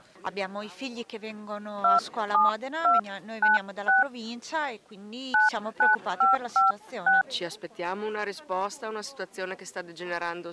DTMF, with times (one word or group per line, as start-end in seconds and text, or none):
1.8-4.0 27296
5.3-7.2 99556